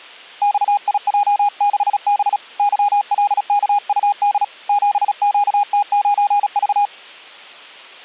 Morse code, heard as a keyed tone, hand-sent with a paddle, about 36 wpm, 820 Hz. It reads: XIJ6B YLKUD 7QT9V